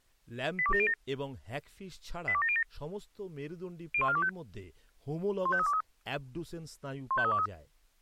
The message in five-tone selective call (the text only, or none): 82707 82707 01425 15323 15323